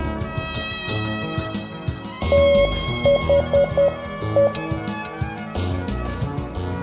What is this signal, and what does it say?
Morse code, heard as a keyed tone, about 10 wpm, 560 Hz, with room echo. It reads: THE